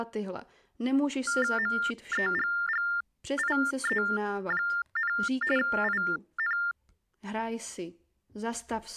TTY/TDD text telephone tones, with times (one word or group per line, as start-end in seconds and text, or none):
1.6-5.1 MEGGIE,
5.6-6.6 IN